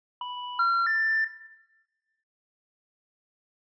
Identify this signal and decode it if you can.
Telephone call progress tone (North American plan), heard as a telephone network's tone, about 980, 1370, 1800 Hz, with room echo. Special information tone.